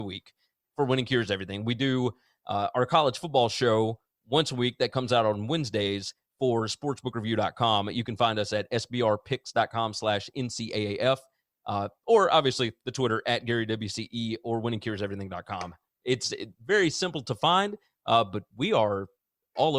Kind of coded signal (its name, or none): none